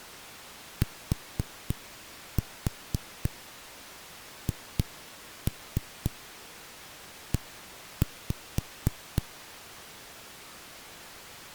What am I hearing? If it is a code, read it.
Tap code, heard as knocks on a wall, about 4 knocks a second. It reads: THE